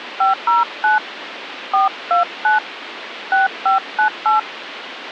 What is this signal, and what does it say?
DTMF, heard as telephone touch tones, dialled by hand, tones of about 130 ms, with phone line noise. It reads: 509 429 6598